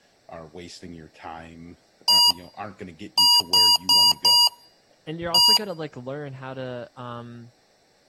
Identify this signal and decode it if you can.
Beep code, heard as beeps from a small speaker, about 960 Hz, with room echo and speech in English. 1-4-1. In Phoenix BIOS tables: address line failure in the first 64 KB of memory.